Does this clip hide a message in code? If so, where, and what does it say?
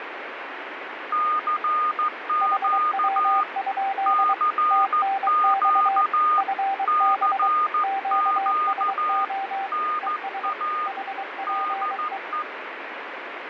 Yes: Morse code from 1.1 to 12.5 s, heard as two keyed tones, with radio static. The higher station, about 14 wpm, 1220 Hz: CQ CQ CQ NA DE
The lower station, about 23 wpm, 780 Hz: HW? TNX FB QSO ES HPE